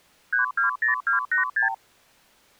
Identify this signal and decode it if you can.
Multi-frequency trunk signalling (R2, with the far end's replies), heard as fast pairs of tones, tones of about 120 ms. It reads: 320286